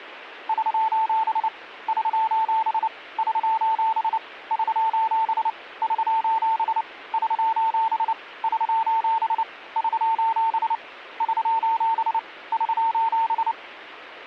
Morse code, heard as a keyed tone, hand-sent with a paddle, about 29 wpm, 900 Hz. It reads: <SOS> <SOS> <SOS> <SOS> <SOS> <SOS> <SOS> <SOS> <SOS> <SOS>